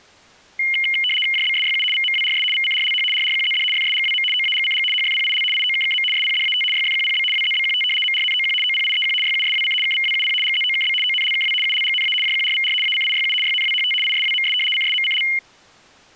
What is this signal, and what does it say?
RTTY (75 baud, 850 Hz shift), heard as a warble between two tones, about 2550 Hz centre. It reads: JBSYU VMWRS VCRLH RRQZD FSGWM OAGCG HFPIL IOKKM SPDAT YFQPB WZBQT MRNOQ OPIEQ YUSWC KVWUP GZOKB ONLKW ULGNA JQRVR ACIYU YNWHT ISWMS CSMCL